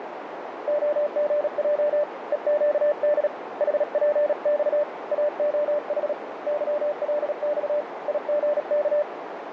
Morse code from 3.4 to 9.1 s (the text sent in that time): HPX AOH YLX IGK